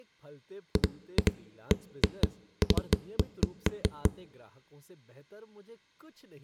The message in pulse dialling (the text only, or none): none